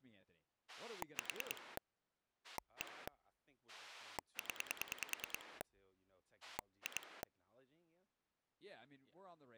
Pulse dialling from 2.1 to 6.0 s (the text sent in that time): 1 0